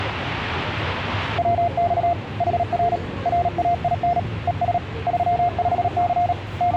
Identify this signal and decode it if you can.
Morse code, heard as a keyed tone, hand-sent with a paddle, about 37 wpm, 700 Hz, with the noise of a subway station. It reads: WX HR RAIN ES 35C …